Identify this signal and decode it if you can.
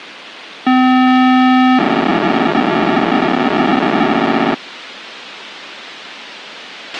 POCSAG pager data (512 baud), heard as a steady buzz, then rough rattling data, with radio hiss and a squelch burst at the end.